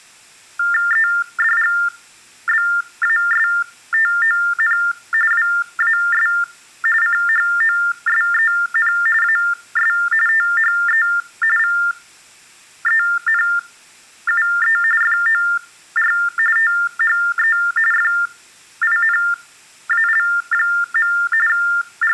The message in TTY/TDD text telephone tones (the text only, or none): EDGBASTON WAS CHOSEN AS THE VENUE FOR THE FINAL. …